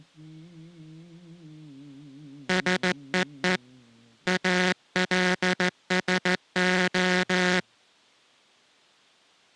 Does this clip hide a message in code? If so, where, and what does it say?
Yes: Morse code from 2.4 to 7.7 s, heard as a buzzer, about 15 wpm. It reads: SEE ALSO